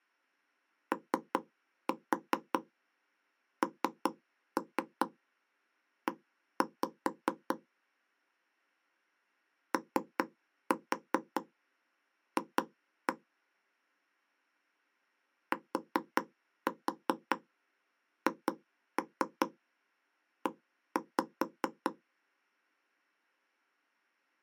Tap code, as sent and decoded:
3-4 3-3 1-5 / 3-4 2-1 / 4-4 2-3 1-5
ONE OF THE

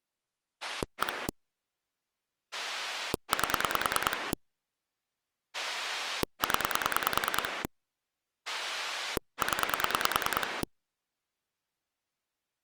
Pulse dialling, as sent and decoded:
1 / 8 / 10 / 10
1 8 0 0

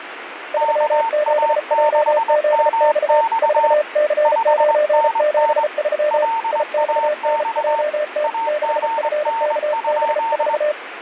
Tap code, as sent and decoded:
none

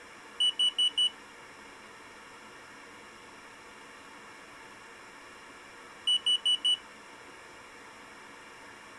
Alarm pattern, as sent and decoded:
4 beeps and a pause
temporal four

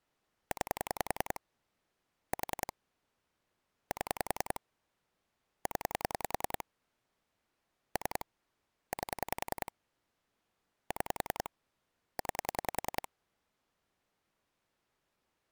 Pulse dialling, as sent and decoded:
9 / 4 / 7 / 10 / 3 / 8 / 6 / 9
9 4 7 0 3 8 6 9

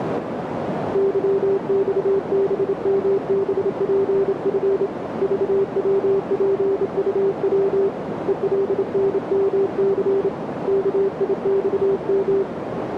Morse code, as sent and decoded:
-.-- -..- -... -- -... .--. ..-. / ...- .-- .--. ..- .-- / . .-.. -. -- -.-. / -.- .. -..- --
YXBMBPF VWPUW ELNMC KIXM

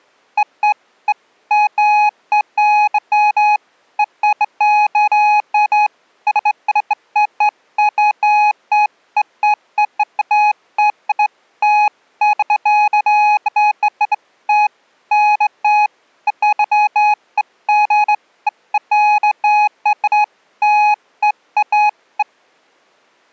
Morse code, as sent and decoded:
none

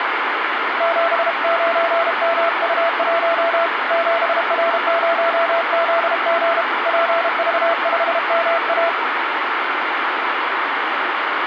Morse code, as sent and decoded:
--... ----. -- ..- .---- / --... .-. ----- --.. --. / .--. ...- ..... -- .-
79MU1 7R0ZG PV5MA

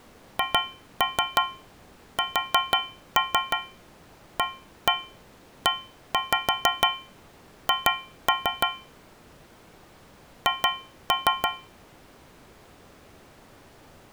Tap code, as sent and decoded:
2-3 4-3 1-1 1-5 2-3 / 2-3
HSAEH H

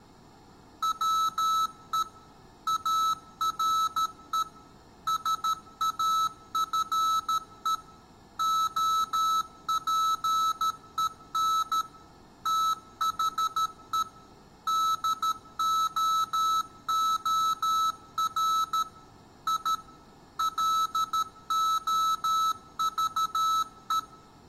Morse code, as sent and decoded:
.-- . / .- .-. . / ... .- ..-. . / --- .--. . -. / - .... . / -.. --- --- .-. / .. / .-.. --- ...- .
WE ARE SAFE OPEN THE DOOR I LOVE

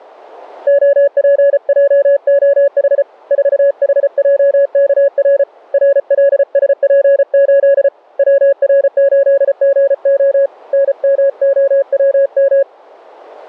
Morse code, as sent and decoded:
--- .--. .--- --- .... / ....- .... .--- -.- .-. / .-. .-.. ... .--. ---.. / .-- .-. ---.. --. --- / -. -- --- .-- --
OPJOH 4HJKR RLSP8 WR8GO NMOWM

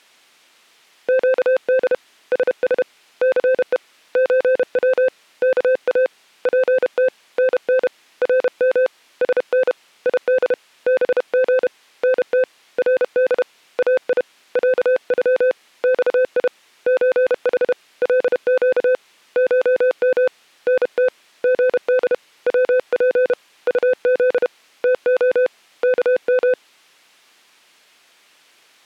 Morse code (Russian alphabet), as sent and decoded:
--.- -.. / ... ... / -.-. . / ---. .-- / -.- .- / .--. - / -. -. / .-. -- / ... -. / .. -.. / -... --. / -. - / .-. -.. / .- .. / .-.- ..-- / -..- .. / ---. .... / .-.. --.- / ---- -- / -. - / --. -.. / .-- .--. / ..- --.. / - --- / -.- --
ЩД СС ЦЕ ЧВ КА ПТ НН РМ СН ИД БГ НТ РД АИ ЯЮ ЬИ ЧХ ЛЩ ШМ НТ ГД ВП УЗ ТО КМ

